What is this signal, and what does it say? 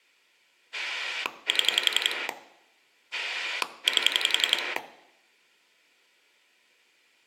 Pulse dialling, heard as a rotary dial, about 11 pulses a second, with room echo. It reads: 7 8